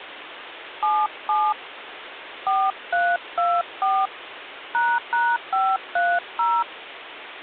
DTMF, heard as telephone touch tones, dialled by hand, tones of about 240 ms, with phone line noise. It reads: 77 4324 ##530